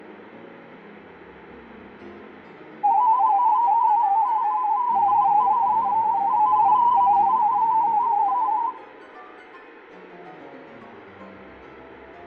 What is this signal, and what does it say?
Multi-tone FSK (Olivia or MFSK type), about 250 Hz wide, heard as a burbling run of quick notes, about 31.25 baud, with fading and room echo.